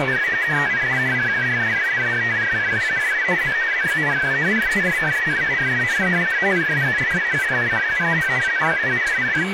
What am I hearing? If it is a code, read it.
Multi-tone FSK (Olivia or MFSK type), about 500 Hz wide, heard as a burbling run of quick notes, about 62.5 baud, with radio static, a steady whistle near 2280 Hz and speech in English.